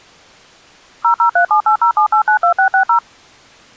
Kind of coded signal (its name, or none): DTMF